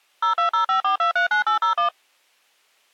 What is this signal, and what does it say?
DTMF, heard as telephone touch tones, dialled by machine, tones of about 110 ms. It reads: 02054239801